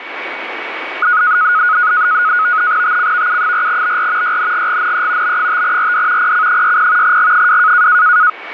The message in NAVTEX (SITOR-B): TCVU4BR YNGGNE B5RD PC60 G2

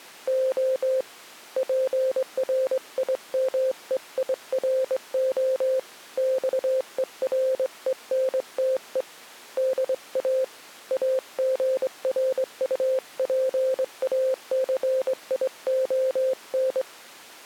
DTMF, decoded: none

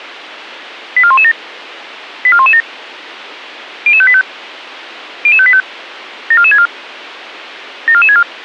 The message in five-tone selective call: 84117 84117 00585 00585 74464 74464

